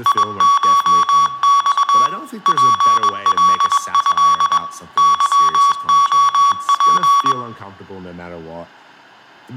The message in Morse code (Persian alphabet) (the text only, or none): یشخ پلض ظعپ